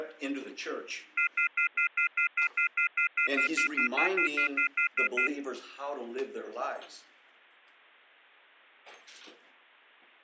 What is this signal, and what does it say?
Telephone call progress tone (North American plan), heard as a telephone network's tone, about 1400, 2050, 2450, 2600 Hz, 0.1 s on and 0.1 s off. Off-hook warning tone.